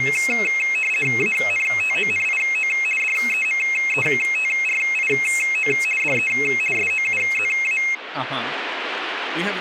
RTTY (50 baud, 450 Hz shift), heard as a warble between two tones, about 2350 Hz centre, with radio static and speech in English. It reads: ANTONIO DEMETRIO DE SOUZA